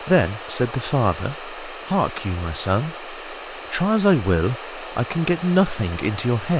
A steady tone, with phone line noise, room echo and speech in English. There is no code.